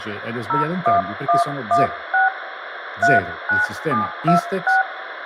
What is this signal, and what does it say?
DTMF, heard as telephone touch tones, dialled by hand, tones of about 150 ms, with radio hiss, room echo and speech in Italian. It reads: 01116 39726